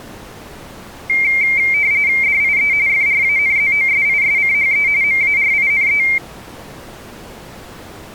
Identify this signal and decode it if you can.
RTTY (45.45 baud, 170 Hz shift), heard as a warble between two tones, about 2200 Hz centre. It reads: DIE FRANZOSISCHE MARINE